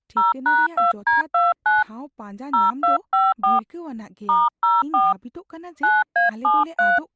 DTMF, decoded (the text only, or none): 0#2D29 0254 *04 9A73